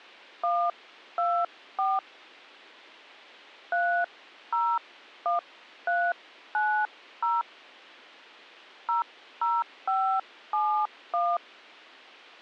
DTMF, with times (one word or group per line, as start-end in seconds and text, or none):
0.4-2.0 124
3.7-7.4 301390
8.9-11.4 00571